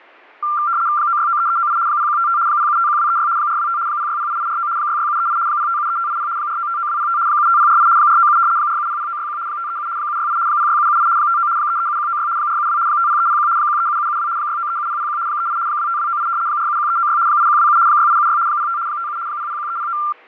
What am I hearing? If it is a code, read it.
RTTY (75 baud, 170 Hz shift), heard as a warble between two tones, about 1280 Hz centre, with fading. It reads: 9693398 0155 0751236 425 0608849 66738 0573580 4959205 75048 497 4700961 537 768 06778 59 337196 472 50301 137772 6937001 38 25298 471396 8127 6876 05 57 001309